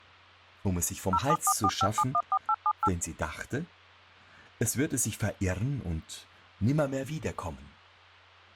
DTMF, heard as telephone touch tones, dialled by machine, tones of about 60 ms, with speech in German. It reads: 07445714878